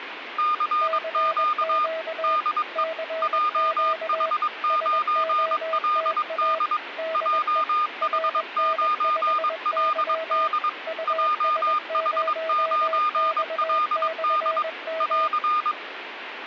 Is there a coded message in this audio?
Yes: Morse code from 0.3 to 15.8 s, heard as two keyed tones, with radio static. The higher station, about 22 wpm, 1220 Hz: CQ DE JH9LD JH9LD JH9LD <AR>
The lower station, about 21 wpm, 650 Hz: CQ CQ SOTA DE RN5Y US0X/M